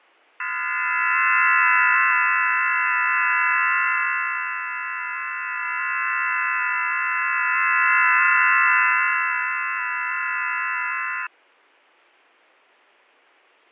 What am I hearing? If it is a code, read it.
FT8 (several signals at once), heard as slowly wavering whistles, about 6.25 baud, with fading.